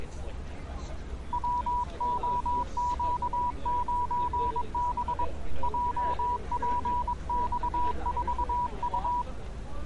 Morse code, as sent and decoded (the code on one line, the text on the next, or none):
.-- --- --.- ----. -... / .--- .--. -..- ....- ..-
WOQ9B JPX4U